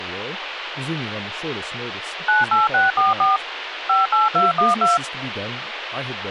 DTMF, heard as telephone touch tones, dialled by machine, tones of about 160 ms, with phone line noise and speech in English. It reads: 98644 58212